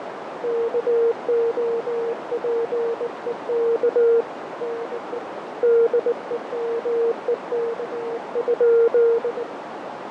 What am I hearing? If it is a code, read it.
Morse code, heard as a keyed tone, hand-sent with a bug key, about 19 wpm, 460 Hz, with heavy radio static, fading and a narrow filter. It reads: KOPEK NE DEMEK?